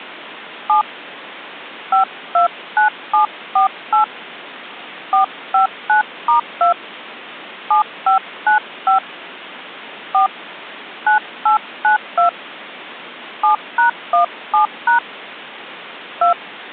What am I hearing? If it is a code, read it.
DTMF, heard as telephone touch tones, dialled by hand, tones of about 120 ms. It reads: 7 529748 459*2 7595 4 9892 7#17# 2